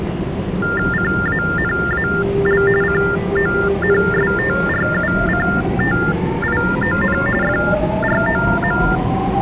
TTY/TDD text telephone tones (45.45 baud Baudot), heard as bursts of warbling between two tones, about 400 Hz shift, 1600 Hz centre, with the noise inside a subway train. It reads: CANAL CONSTRUCTION FROM